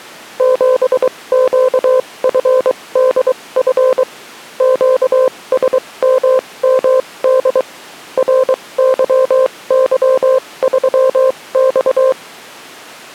Morse code, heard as a keyed tone, machine-sent, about 23 wpm, spaced as for 19 wpm, 520 Hz. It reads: 7QFDF QSMMD RYY3X